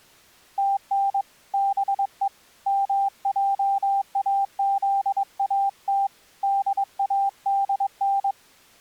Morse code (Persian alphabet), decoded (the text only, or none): تن به مجازات دادن